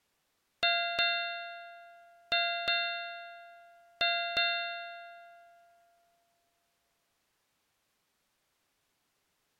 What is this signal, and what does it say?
Ship's bell, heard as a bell. 6. Six half-hours of the watch have passed.